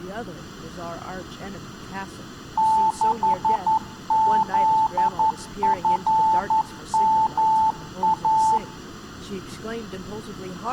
Morse code, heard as a keyed tone, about 11 wpm, 880 Hz, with speech in English. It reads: 6ZFMA